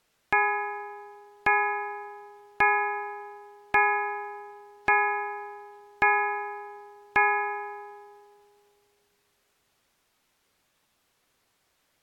Clock strike, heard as a bell. 7. Seven o'clock.